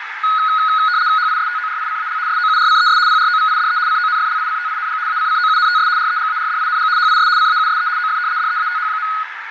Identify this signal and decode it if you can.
RTTY (75 baud, 170 Hz shift), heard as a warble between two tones, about 1360 Hz centre, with radio static, fading and a narrow filter. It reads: HISTORICAL SOURCES PROVIDE CONFLICTING ACCOUNTS REGARDING HIS CAUSE OF DEATH.